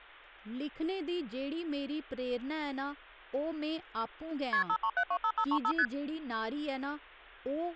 Multi-frequency trunk signalling (R1, as on North American trunks), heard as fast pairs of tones, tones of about 70 ms, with speech in Dogri. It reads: KP 53725535 ST